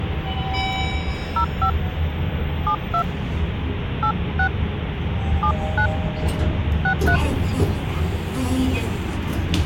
DTMF, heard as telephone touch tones, dialled by hand, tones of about 80 ms, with phone line noise and the noise inside a lift. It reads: 05 72 86 79 63